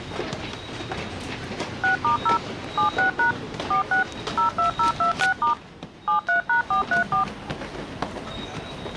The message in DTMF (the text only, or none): 6*0 76# 46 02026* 73#434